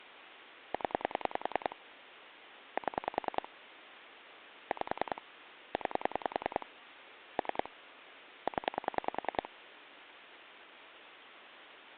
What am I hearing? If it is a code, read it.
Pulse dialling, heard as clicks on a phone line, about 10 pulses a second. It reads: 0 7 5 9 3 0